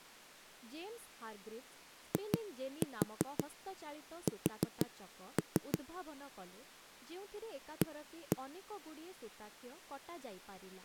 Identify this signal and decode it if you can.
Tap code, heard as knocks on a wall, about 6 knocks a second, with speech in Odia. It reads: IS A